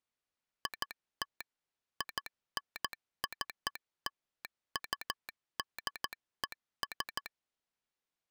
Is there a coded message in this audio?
Yes: Morse code (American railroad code) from 0.6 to 7.3 s, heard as a telegraph sounder, machine-sent. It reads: IT INCLUDES